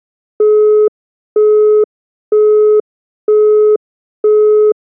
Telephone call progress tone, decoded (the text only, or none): busy tone